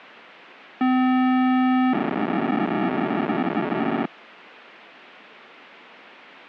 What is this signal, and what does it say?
POCSAG pager data (512 baud), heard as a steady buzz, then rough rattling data.